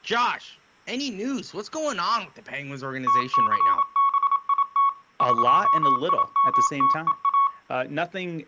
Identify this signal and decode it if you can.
Morse code (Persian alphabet), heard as a keyed tone, machine-sent, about 27 wpm, 1110 Hz, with speech in English. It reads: تثبیت قیمتها